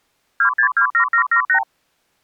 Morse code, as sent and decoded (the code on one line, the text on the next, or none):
none